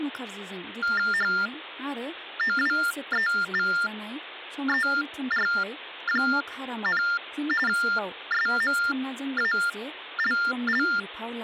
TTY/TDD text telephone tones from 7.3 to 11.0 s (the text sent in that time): SMALL